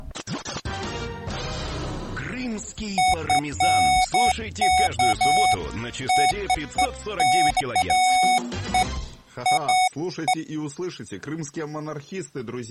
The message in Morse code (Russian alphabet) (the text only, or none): none